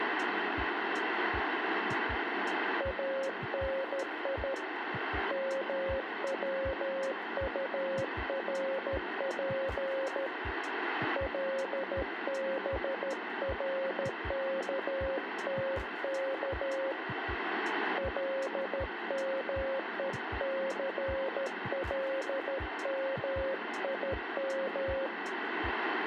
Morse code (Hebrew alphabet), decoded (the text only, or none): אני מצטרף לברכתך למוסלמים